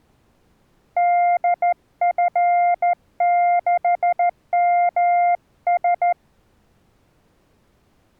Morse code, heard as a keyed tone, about 14 wpm, 700 Hz. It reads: DF6MS